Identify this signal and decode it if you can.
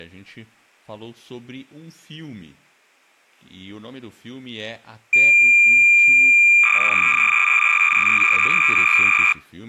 Cassette data (Kansas City type), 300 baud, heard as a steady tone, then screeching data, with speech in Portuguese.